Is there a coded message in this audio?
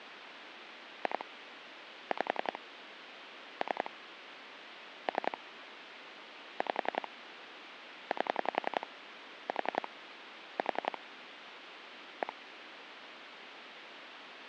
Yes: pulse dialling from 1.1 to 12.3 s, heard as clicks on a phone line, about 11 pulses a second, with phone line noise. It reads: 2 5 3 3 5 8 4 4 1